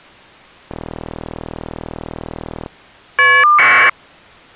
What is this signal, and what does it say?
Caller ID data burst, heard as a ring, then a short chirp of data, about 1200 baud.